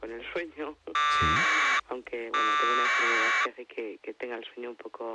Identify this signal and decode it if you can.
Packet radio (AX.25, as in APRS), 1200 baud, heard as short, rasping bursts.